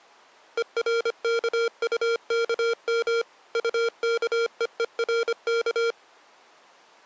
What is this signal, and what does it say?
Morse code, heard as electronic beeps, machine-sent, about 25 wpm, 460 Hz. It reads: ERKUKM UKEERK